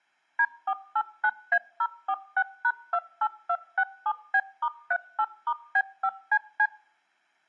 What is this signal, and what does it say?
DTMF, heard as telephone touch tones, dialled by machine, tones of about 60 ms. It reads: D489A046#28267B*38*B5CC